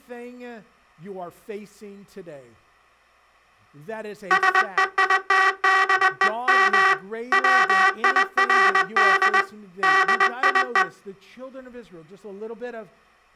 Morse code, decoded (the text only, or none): SEITDEM WIRD DIE